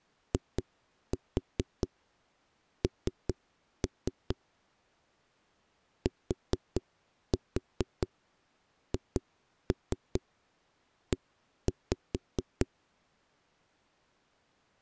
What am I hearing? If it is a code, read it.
Tap code, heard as knocks on a wall, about 4 knocks a second. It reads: IN THE